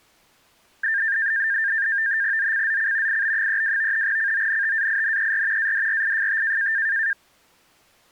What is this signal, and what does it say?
NAVTEX (SITOR-B), 100 baud, 170 Hz shift, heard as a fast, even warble, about 1700 Hz centre. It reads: ZCZC IB32 CONTAINER ADRIFT